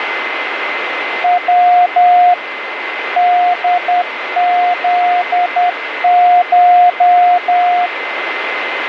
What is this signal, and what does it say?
Morse code (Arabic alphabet), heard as a keyed tone, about 10 wpm, 710 Hz, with radio static and a steady whistle near 2060 Hz. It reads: و دذش